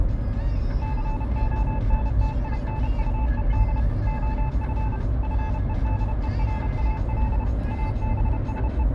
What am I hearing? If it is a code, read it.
Morse code, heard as a keyed tone, machine-sent, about 31 wpm, 870 Hz, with the noise inside a car. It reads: CONTINUED OF FEDERAL …